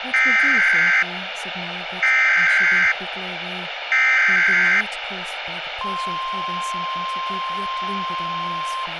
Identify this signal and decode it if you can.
Emergency Alert System (SAME) tones (header bursts, then the 1050 Hz attention tone), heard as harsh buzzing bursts, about 520.83 baud, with radio hiss and speech in English.